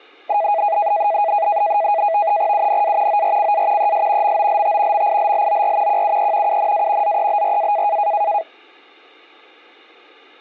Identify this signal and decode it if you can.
NAVTEX (SITOR-B), 100 baud, 170 Hz shift, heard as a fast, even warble, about 740 Hz centre. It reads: UNA ORCA ES MOLT MILLOR QUE UNA ZEBRA